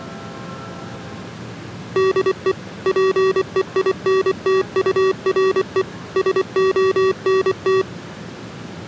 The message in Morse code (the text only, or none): DE PEINTURE SONT